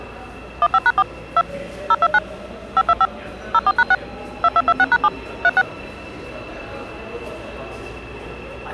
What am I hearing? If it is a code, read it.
DTMF, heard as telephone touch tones, dialled by machine, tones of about 50 ms, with the noise of a subway station. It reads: 15#4 2 029 525 04#6 2226#7 36